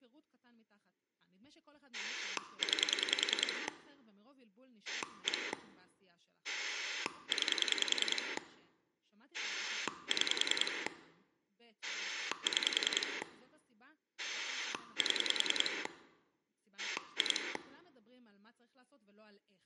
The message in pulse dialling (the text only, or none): 9 1 9 6 6 7 2